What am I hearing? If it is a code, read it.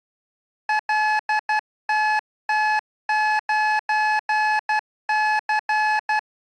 Morse code, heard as electronic beeps, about 12 wpm, 860 Hz. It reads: LTT9C